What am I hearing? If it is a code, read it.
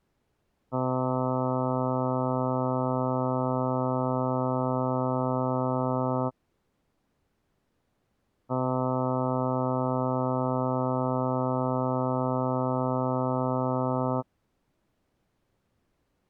Ship horn signal, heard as a ship's horn, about 130 Hz. 2 long. At sea: a vessel under power that has stopped in fog.